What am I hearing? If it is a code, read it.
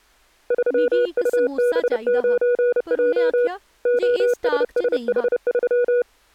Morse code, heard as a keyed tone, hand-sent with a paddle, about 30 wpm, 490 Hz, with speech in Dogri. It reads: 3UB9J OSSH3